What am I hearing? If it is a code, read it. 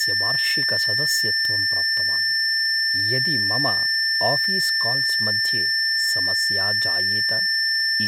A steady tone, with speech in Sanskrit. There is no code.